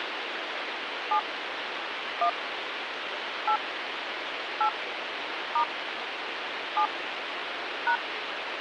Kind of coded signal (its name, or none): DTMF